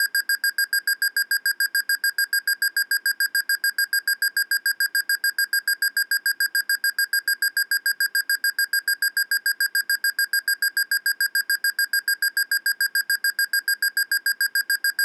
Evenly repeated beeps. There is no code.